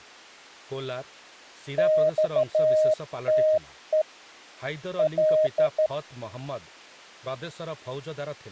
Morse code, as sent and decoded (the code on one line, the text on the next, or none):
-..- - . / .-..
XTE L